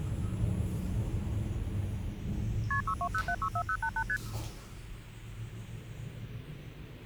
Multi-frequency trunk signalling (R1, as on North American trunks), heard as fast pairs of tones, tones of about 70 ms, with hum and the noise inside a lift. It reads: KP 620764088 ST